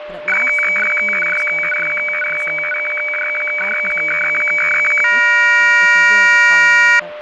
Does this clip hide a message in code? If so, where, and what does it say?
Yes: weather fax (radiofax), 120 lines a minute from 0.3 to 7.0 s, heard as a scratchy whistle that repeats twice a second, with radio static, fading, a steady whistle near 600 Hz and speech in English.